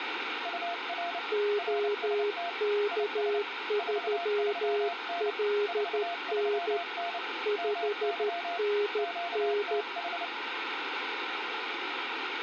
Morse code, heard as two keyed tones, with radio static. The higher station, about 29 wpm, 690 Hz: UR RST IS 43N 43N MY QTH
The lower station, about 13 wpm, 410 Hz: OK3LN 5NN